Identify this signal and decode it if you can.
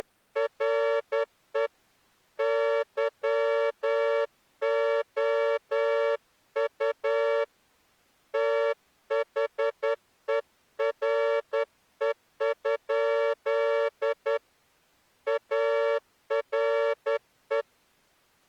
Morse code, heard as a horn, hand-sent with a straight key, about 10 wpm. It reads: … YOU THERE? ARE